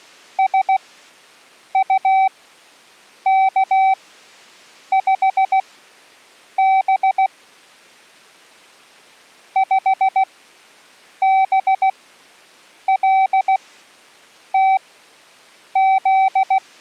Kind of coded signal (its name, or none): Morse code